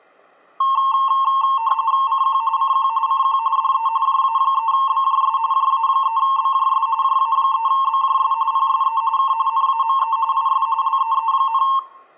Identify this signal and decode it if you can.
RTTY (45.45 baud, 170 Hz shift), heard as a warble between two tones, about 990 Hz centre, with room echo. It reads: CQ CQ CQ DE JA3BJS JA3BJS JA3BJS PSE K NAME IS LEE,